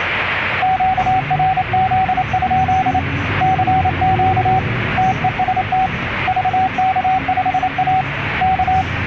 Morse code, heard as a keyed tone, hand-sent with a paddle, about 28 wpm, 760 Hz, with radio static and the noise inside a bus. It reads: QRZ? CQ TEST VK5A K